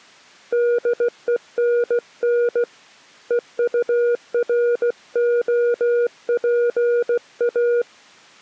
Morse code, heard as a keyed tone, hand-sent with a paddle, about 16 wpm, 480 Hz. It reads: DENN EUROPA